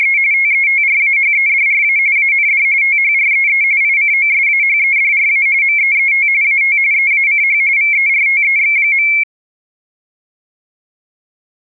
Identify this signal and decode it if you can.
RTTY (45.45 baud, 170 Hz shift), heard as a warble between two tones, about 2250 Hz centre. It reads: … TETRAHEDRA AND THREE ICOSAHEDRA MEET AT EACH VERTEX.